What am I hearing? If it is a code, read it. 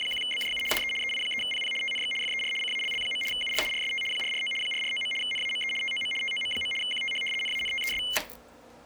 RTTY (75 baud, 850 Hz shift), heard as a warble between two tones, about 2550 Hz centre, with kitchen noise. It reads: … DE EI3PP TNX FER CALL. UR RST 449 449. NAME TOM TOM. QTH NANTES